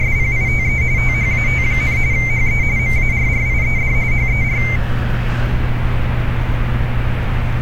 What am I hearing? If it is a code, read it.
RTTY (45.45 baud, 170 Hz shift), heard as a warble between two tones, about 2200 Hz centre, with street noise. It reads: … THAT, HE MARRIED HER